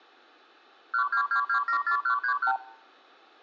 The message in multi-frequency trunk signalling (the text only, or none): 122274131